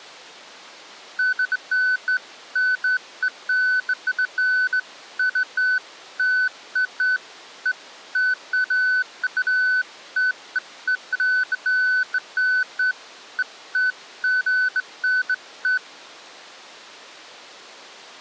Beeps of irregular length. There is no code.